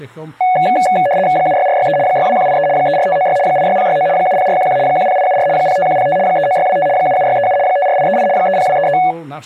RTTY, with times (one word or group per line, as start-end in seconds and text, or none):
1.4-2.0 76463
2.1-2.7 62183
2.8-3.4 34596
3.5-4.1 86069
4.2-4.8 70411
4.9-5.5 10874
5.6-6.2 05105
6.3-6.9 39625
7.0-7.6 77637
7.7-8.3 54838
8.4-9.0 30233